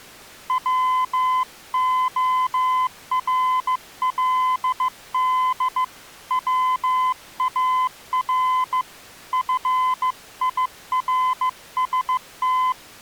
Morse code, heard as a keyed tone, hand-sent with a bug key, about 15 wpm, 1020 Hz. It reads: WORLD WAR FIRST